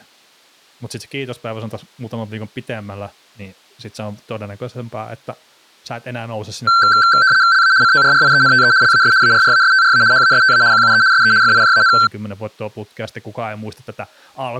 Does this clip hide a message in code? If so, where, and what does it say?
Yes: RTTY (75 baud, 170 Hz shift) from 6.7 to 12.1 s, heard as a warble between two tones, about 1450 Hz centre, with speech in Finnish. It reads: LA CORRIENTE LAS ARRASTRA HASTA QUE SE FIJAN